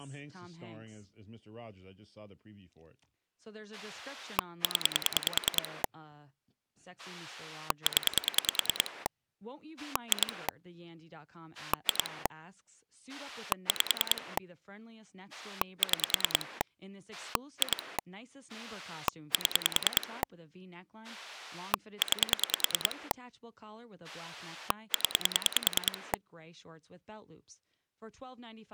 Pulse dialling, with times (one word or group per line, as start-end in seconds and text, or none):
3.7-5.8 0
7.0-9.1 0
9.8-10.5 2
11.5-12.3 2
13.1-14.4 5
15.3-16.6 6
17.1-18.0 2
18.5-20.2 7
21.0-23.1 9
24.0-26.1 0